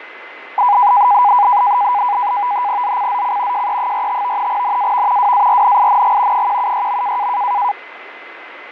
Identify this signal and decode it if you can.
NAVTEX (SITOR-B), 100 baud, 170 Hz shift, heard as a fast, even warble, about 900 Hz centre, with radio static, fading and a steady whistle near 2040 Hz. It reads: ZCZC JE45 NAV WARNING 176.